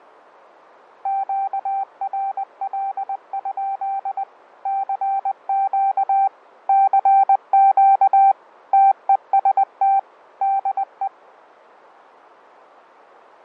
Morse code, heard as a keyed tone, machine-sent, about 20 wpm, 780 Hz, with fading. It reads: QRL? CQ CQ TEST DE